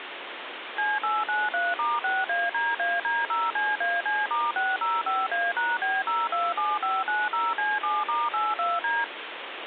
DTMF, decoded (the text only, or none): C893*6ADAD0CAC*605A#B027590C7*82D